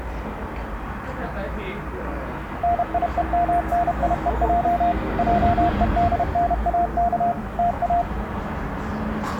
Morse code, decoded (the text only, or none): NIEMNIEJ JEDNAK TA